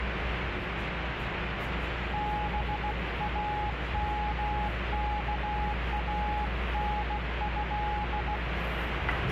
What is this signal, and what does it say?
Morse code (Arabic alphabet), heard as a keyed tone, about 16 wpm, 840 Hz, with radio static and the noise inside a subway train. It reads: بامكانه